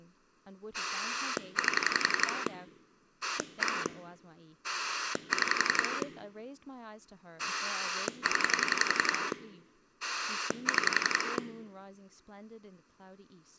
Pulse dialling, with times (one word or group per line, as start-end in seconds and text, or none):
0.7-2.5 8
3.2-3.9 1
4.6-6.0 6
7.4-9.3 0
10.0-11.4 6